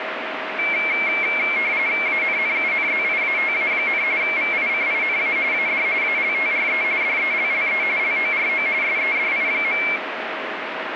RTTY (45.45 baud, 170 Hz shift), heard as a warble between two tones, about 2250 Hz centre, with radio static. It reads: ANNUNZIATA, VICINA AD ALTRE DELLE LORO SEDI.